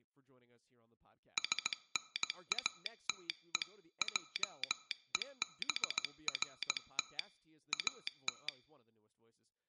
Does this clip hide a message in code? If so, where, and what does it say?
Yes: Morse code (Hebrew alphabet) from 1.3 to 8.5 s, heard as a telegraph sounder, hand-sent with a paddle, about 17 wpm, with speech in English. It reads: שנאתו עוברת את